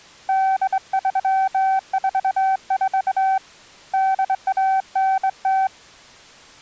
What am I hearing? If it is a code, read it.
Morse code (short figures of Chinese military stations), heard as a keyed tone, hand-sent with a straight key, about 22 wpm, 770 Hz. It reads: 8344 8190